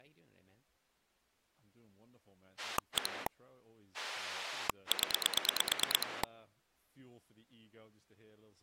Pulse dialling, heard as a rotary dial, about 9 pulses a second, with speech in English. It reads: 1 0